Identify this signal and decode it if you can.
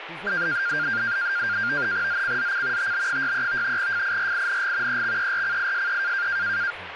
NAVTEX (SITOR-B), 100 baud, 170 Hz shift, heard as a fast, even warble, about 1500 Hz centre, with radio static and speech in English. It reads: ZCZC TB63 FIRING EXERCISE